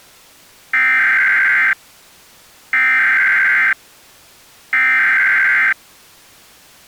Emergency Alert System (SAME) tones (header bursts), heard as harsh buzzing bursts, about 520.83 baud.